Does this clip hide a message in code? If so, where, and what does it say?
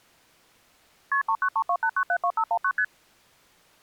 Yes: multi-frequency trunk signalling (R1, as on North American trunks) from 1.1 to 2.8 s, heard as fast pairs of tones, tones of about 70 ms. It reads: KP 39328972519 ST